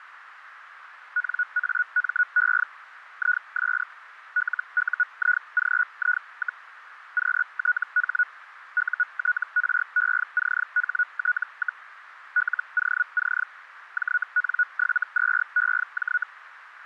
Hellschreiber (Feld-Hell, 122.5 baud), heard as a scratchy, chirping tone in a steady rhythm, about 1460 Hz, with radio static. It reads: NAME IS LUIGI, QTH UTRECHT, LOC JN72EJ